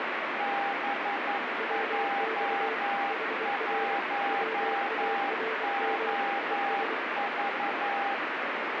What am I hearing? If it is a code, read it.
Morse code, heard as two keyed tones, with heavy radio static. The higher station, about 11 wpm, 800 Hz: BJ1OV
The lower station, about 24 wpm, 450 Hz: WX HR WARM ES